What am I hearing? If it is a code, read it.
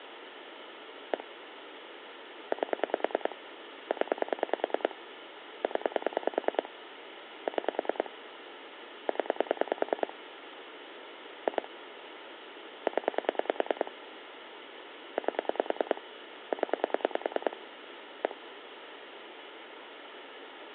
Pulse dialling, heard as clicks on a phone line, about 10 pulses a second, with phone line noise. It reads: 1 8 0 0 6 0 2 0 8 0 1